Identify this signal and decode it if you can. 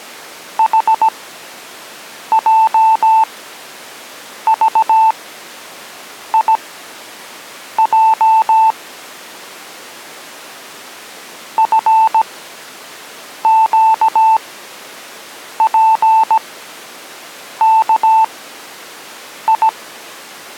Morse code, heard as a keyed tone, machine-sent, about 17 wpm, spaced as for 6 wpm, 890 Hz. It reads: HJVIJ FQPKI